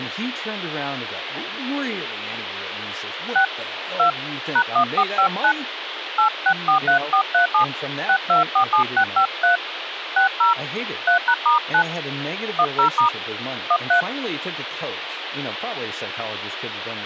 DTMF, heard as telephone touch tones, dialled by hand, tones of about 100 ms, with phone line noise and speech in English. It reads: 6 2 #1459 8643437 6247653 60 3#*9 10* 13